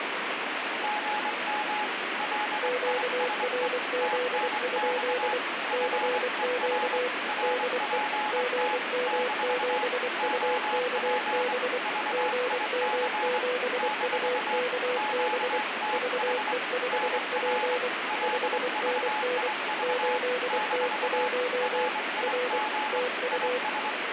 Morse code, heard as two keyed tones, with radio static. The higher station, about 23 wpm, 850 Hz: GM LISE TNX FER RPT - OP VIC - QTH NR LVIV - RIG IS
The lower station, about 24 wpm, 500 Hz: QRZ? CQ DE GM7UKB GM7UKB VE5P 5NN 8T1 R TU